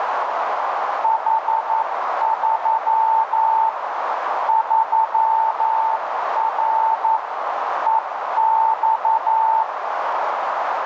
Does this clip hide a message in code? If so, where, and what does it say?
Yes: Morse code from 1.0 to 9.7 s, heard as a keyed tone, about 11 wpm, 890 Hz, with heavy radio static and a narrow filter. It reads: H3 3R EX